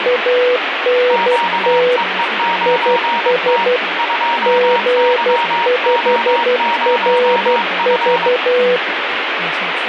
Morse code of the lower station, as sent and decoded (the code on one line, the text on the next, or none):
.- -. - / .. ... / --. ..... .-. ...-
ANT IS G5RV